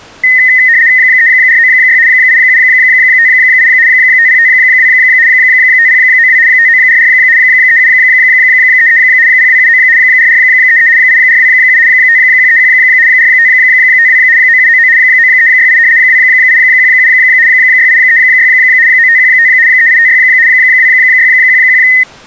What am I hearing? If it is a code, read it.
RTTY (75 baud, 170 Hz shift), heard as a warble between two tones, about 1950 Hz centre. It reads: 3496 8758 5052 5092 5944 3733 0279 4433 8427 5131 4552 9799 9368 2817 6836 9515 3856 2611